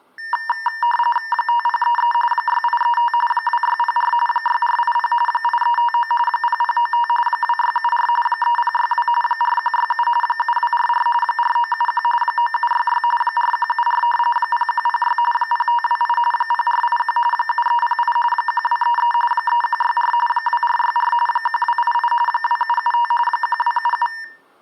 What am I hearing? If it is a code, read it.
RTTY (45.45 baud, 850 Hz shift), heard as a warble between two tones, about 1380 Hz centre. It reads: 5033 6835 2604 6480 8359 0095 2674 3062 4167 7244 4971 9766 4174 0106 0528 0481 7308 1233 3164 2464 1288 2775 1277